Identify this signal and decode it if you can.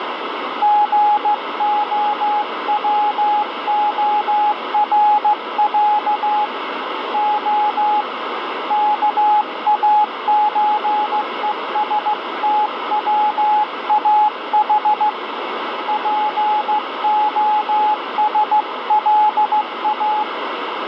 Morse code (Russian alphabet), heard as a keyed tone, hand-sent with a straight key, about 15 wpm, 840 Hz, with radio static. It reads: ГОВОРЯ О КАЧЕСТВАХ ПОСЛА